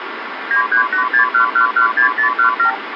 Multi-frequency trunk signalling (R2, with the far end's replies), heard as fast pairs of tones, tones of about 100 ms, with phone line noise. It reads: 93861116017